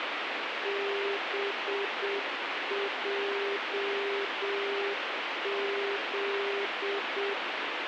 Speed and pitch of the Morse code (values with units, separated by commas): 7 wpm, 400 Hz